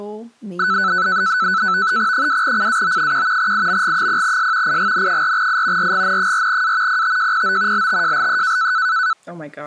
NAVTEX (SITOR-B), 100 baud, 170 Hz shift, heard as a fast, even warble, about 1410 Hz centre, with speech in English. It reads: 2CAO1 IMG0S IGN4I RGN4A PTJPO LTJLE